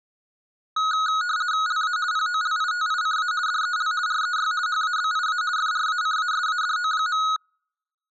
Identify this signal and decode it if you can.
RTTY (50 baud, 170 Hz shift), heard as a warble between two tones, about 1360 Hz centre. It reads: LA POLITICA DEL REY HABIA FRACASADO.